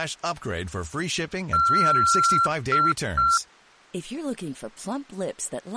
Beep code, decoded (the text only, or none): 1 long, 2 short